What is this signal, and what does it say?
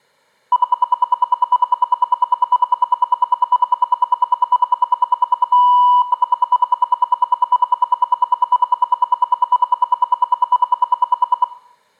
Radio time signal (RWM, Moscow), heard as ten pulses a second, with room echo.